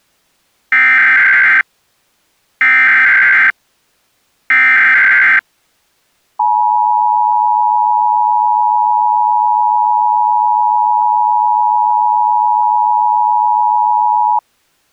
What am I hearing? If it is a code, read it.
Emergency Alert System (SAME) tones (header bursts, then the 853 and 960 Hz attention tone), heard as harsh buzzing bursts, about 520.83 baud.